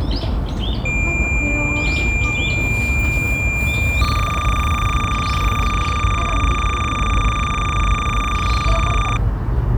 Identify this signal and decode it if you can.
Cassette data (Kansas City type), 300 baud, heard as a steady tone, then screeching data, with the noise of a park.